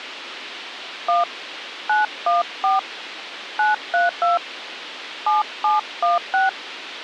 DTMF, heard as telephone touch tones, dialled by hand, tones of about 160 ms, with radio hiss. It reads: 1 914 932 7716